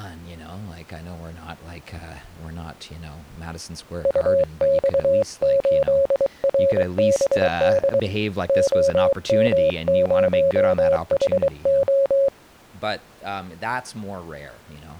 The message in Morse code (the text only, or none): UX8RBD OM0HO